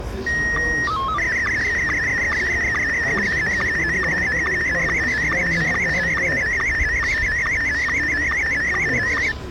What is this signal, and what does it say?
SSTV (slow-scan television), Scottie S1, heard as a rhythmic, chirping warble, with the noise of a residential street.